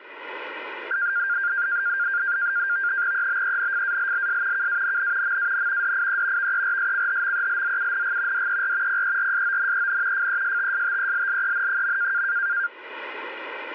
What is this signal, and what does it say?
NAVTEX (SITOR-B), 100 baud, 170 Hz shift, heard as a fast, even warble, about 1500 Hz centre. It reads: EBENFALLS KANN MAN DIE VERSCHMELZUNG DER PERSONEN FESTSTELLEN.